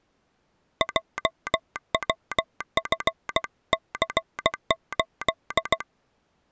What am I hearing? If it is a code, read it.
Morse code, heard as a telegraph sounder, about 16 wpm. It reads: JWFC8